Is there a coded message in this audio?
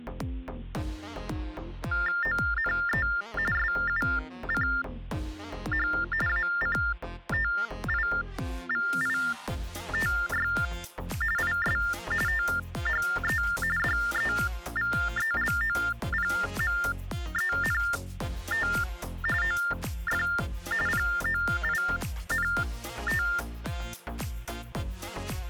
Yes: TTY/TDD text telephone tones (45.45 baud Baudot) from 1.9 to 23.4 s, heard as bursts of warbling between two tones, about 400 Hz shift, 1600 Hz centre. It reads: ONE SUCH ACTIVITY IS THE DEVELOPMENT OF POINT